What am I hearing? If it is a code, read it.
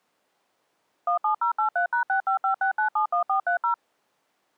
DTMF, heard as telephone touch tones, dialled by machine, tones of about 110 ms. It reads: 17083#6556971430